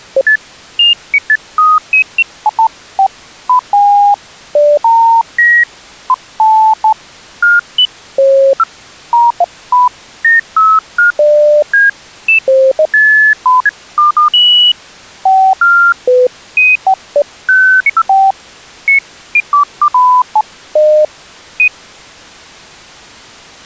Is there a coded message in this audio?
No, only electronic bleeps of random pitch and length.